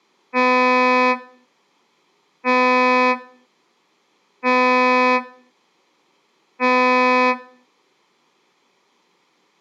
Ship horn signal, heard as a ship's horn, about 250 Hz, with room echo. 4 short. At sea: a pilot vessel's identity signal in fog.